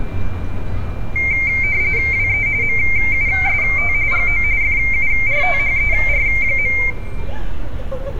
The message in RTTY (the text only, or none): WE MUST GO FURTHER.